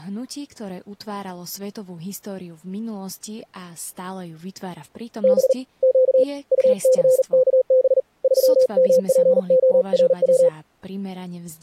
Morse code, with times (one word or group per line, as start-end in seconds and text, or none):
5.2-5.5 B
5.8-6.2 Q
6.5-8.0 UCKB
8.2-10.5 3MPORW